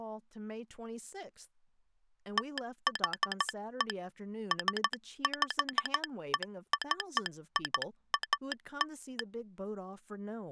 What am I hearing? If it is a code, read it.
Morse code (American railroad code), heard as a telegraph sounder, hand-sent with a straight key, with speech in English. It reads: THE SPECIAL